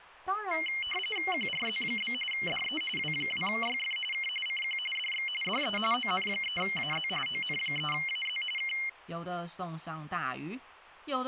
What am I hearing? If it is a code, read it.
RTTY (45.45 baud, 850 Hz shift), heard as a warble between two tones, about 2550 Hz centre, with speech in Chinese. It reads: QRZ? DE W2YF K CQ DX DE ON3AZ ON3AZ K